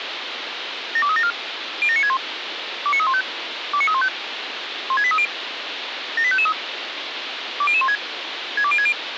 Five-tone selective call (ZVEI), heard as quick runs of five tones, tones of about 70 ms, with radio hiss. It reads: 72374 07961 29315 29315 16830 78553 20016 62060